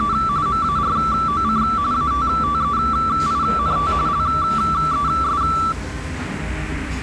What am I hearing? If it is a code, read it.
RTTY (45.45 baud, 170 Hz shift), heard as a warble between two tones, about 1240 Hz centre, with the noise of a restaurant. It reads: … MAROC ATTEINT LES